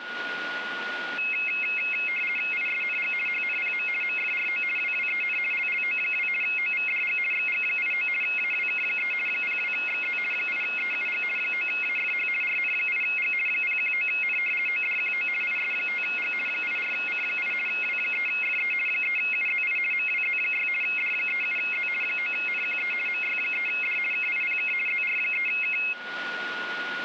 RTTY (50 baud, 450 Hz shift), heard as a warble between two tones, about 2350 Hz centre, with radio static and a steady whistle near 1440 Hz. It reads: ISNG HNPM MFRO WWEN LLO2 OVDG XG89 AWK3 02XZ 8EUG 9AFH RN8G 019N ODQO IS5G 84C8 W3FE 3UZI MWZ6 D37Z 9NQE MY3D KIPK ZR3K